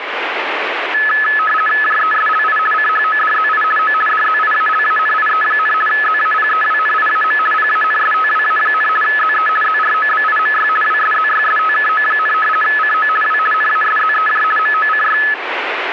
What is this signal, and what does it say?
RTTY (50 baud, 450 Hz shift), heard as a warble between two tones, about 1500 Hz centre, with radio static. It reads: JESLI CHODZI O DZIALANIE, ZAPEWNIAM PANSTWA, ZE ZROBIMY WSZYSTKO, CO W NASZEJ MOCY